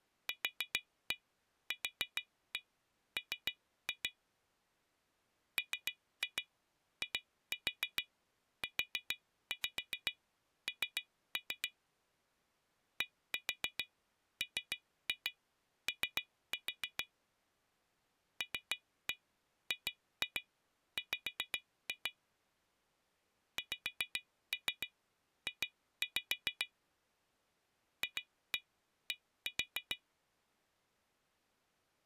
Tap code, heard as taps on glass, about 7 knocks a second. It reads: QQM MIUN DMO LGW XJ FD